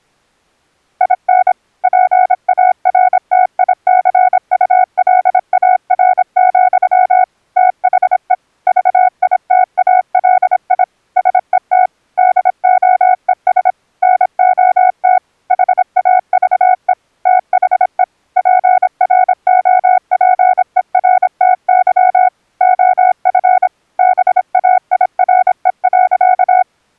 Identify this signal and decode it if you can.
Morse code, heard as a keyed tone, machine-sent, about 26 wpm, 740 Hz. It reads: IN PARTICULAR, THE VITALI SET DOES NOT HAVE THE PROPERTY OF BAIRE.